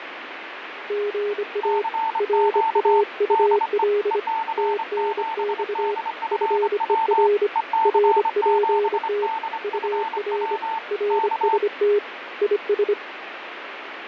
Morse code, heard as two keyed tones, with radio static. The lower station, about 25 wpm, 410 Hz: GA RAUL TNX FER RPT UR RST IS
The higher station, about 25 wpm, 890 Hz: CQ DE EC7DFW EC7DFW K